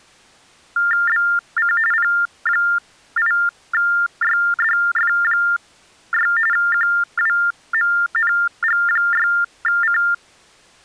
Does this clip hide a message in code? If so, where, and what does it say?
Yes: TTY/TDD text telephone tones (45.45 baud Baudot) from 0.8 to 10.1 s, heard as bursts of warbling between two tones, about 400 Hz shift, 1600 Hz centre. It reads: BC P8YDF6 QWMNG6C